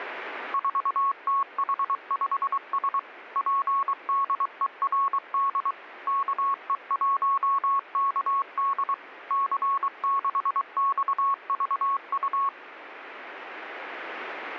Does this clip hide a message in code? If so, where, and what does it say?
Yes: Morse code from 0.5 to 12.5 s, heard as a keyed tone, machine-sent, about 23 wpm, 1100 Hz. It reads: 4TH5S PDERD KE1KD C6XVU